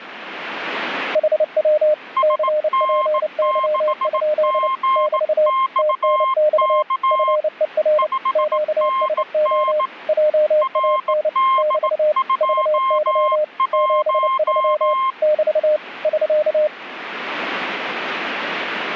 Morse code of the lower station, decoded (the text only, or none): HW CPY? <BT> TNX FER QSO JAN <BT> VY 73 <BT> <SK>